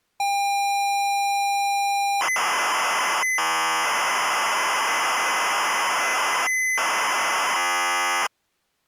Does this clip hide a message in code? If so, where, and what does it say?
Yes: ZX Spectrum tape loading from 0.2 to 8.3 s, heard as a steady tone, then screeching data.